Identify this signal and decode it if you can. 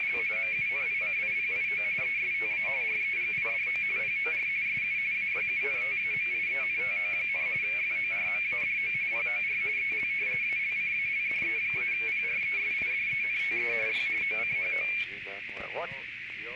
RTTY (45.45 baud, 170 Hz shift), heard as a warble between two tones, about 2300 Hz centre, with radio static and a narrow filter. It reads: … MUNICIPIO ESTA REGIDO POR SU AYUNTAMIENTO, FORMADO POR EL ALCALDE-PRESIDENTE Y OCHO